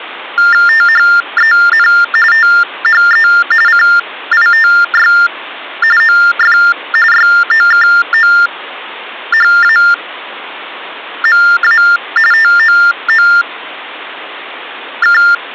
TTY/TDD text telephone tones (45.45 baud Baudot), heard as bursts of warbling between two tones, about 400 Hz shift, 1600 Hz centre. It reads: THEN THE CITY OF YOKOHAMA TOOK